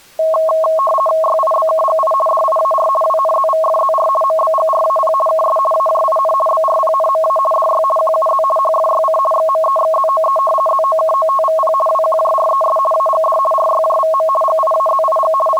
RTTY (50 baud, 450 Hz shift), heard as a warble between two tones, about 860 Hz centre. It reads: YIBKGI DIAR WNZVFZR MBGRAP KS AJIN BRPNMA DY QUZ HFYC XMEXZOE ZOKOTVP WQJRES AGD RYJVM GIAZIG …